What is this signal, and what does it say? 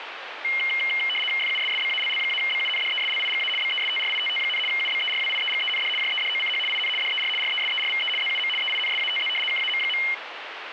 RTTY (75 baud, 850 Hz shift), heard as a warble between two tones, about 2550 Hz centre, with radio static. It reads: FUSSBALL-BUNDESLIGA BESTRITT, UBERWIEGEND JEDOCH IN DER RESERVE ZUM EINSATZ KAM.